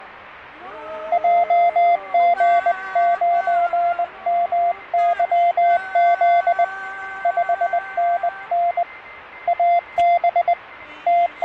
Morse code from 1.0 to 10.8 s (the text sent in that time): JG9MYZ 5NN AB